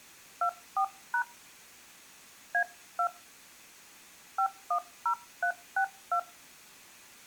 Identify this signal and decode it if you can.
DTMF, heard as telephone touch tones, dialled by hand, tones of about 80 ms. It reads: 24# A2 510362